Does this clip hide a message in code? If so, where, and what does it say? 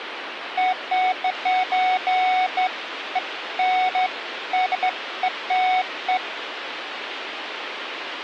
No, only beeps of irregular length, with phone line noise.